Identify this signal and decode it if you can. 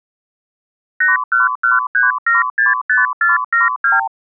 Multi-frequency trunk signalling (R2, with the far end's replies), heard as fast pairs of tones, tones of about 160 ms. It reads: 8113765472